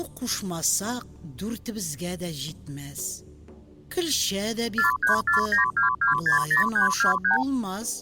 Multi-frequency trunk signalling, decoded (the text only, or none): 43492260323